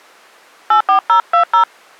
DTMF, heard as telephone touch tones, dialled by hand, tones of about 100 ms. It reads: 84020